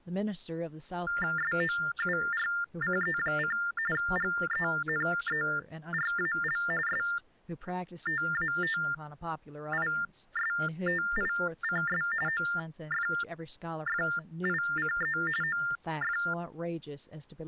TTY/TDD text telephone tones (45.45 baud Baudot), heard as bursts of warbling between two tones, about 400 Hz shift, 1600 Hz centre, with speech in English. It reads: SOURCE: GENERAL STATISTICS OFFICE OF